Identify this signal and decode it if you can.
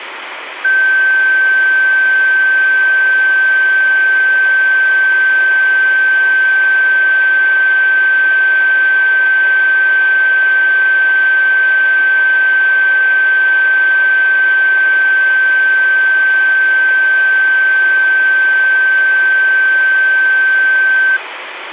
A steady tone. There is no code.